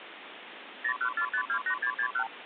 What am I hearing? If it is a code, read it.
Multi-frequency trunk signalling (R2, with the far end's replies), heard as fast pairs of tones, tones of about 80 ms, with phone line noise. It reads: 014528661